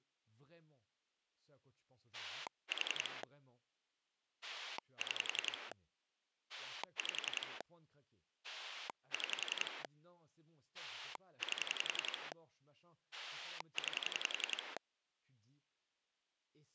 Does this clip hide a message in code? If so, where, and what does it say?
Yes: pulse dialling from 2.1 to 14.8 s, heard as a rotary dial, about 11 pulses a second, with speech in French. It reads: 4 6 5 6 8 9